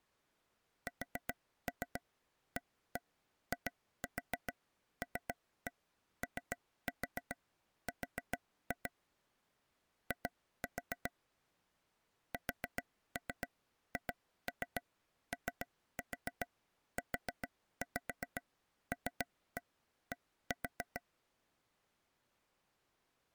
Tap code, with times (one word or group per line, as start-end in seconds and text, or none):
0.9-8.9 SAILOR
10.1-11.1 I
12.3-21.0 SHOULD